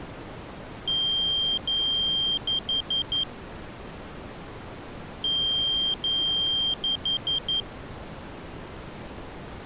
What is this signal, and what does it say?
Beep code, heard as a piezo beeper, played twice, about 3200 Hz. 2 long, 4 short.